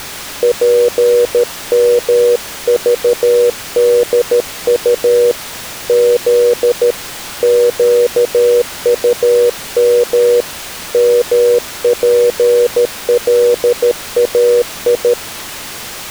Morse code, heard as a keyed tone, hand-sent with a paddle, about 13 wpm, 480 Hz. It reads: PMVDU Z QUM MPLAI